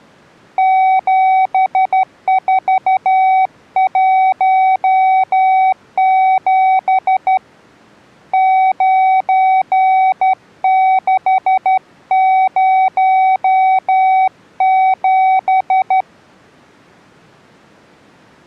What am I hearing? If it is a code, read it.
Morse code, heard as a keyed tone, hand-sent with a straight key, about 12 wpm, 760 Hz. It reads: 7417 9607